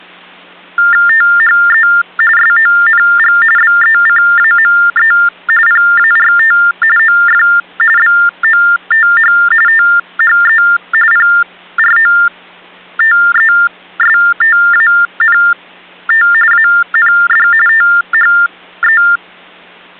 TTY/TDD text telephone tones (45.45 baud Baudot), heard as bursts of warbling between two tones, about 400 Hz shift, 1600 Hz centre. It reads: THE SONG BECAME PART OF BOTH THE PROTESTANT AND THE